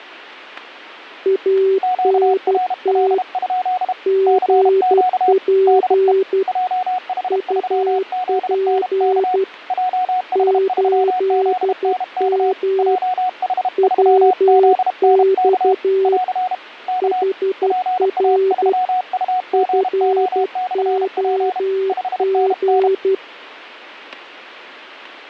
Morse code, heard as two keyed tones, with static crashes. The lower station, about 12 wpm, 380 Hz: ANT GP UP 8M WX HR FOG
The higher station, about 32 wpm, 740 Hz: QRL? CQ DE JH3ZNK JH3ZNK JH3ZNK <AR> K PA3UGO/P 5NN